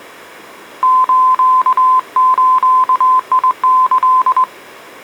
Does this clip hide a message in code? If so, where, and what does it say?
Yes: Morse code (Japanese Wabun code) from 0.8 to 4.5 s, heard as a keyed tone, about 21 wpm, 1030 Hz. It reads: スズキ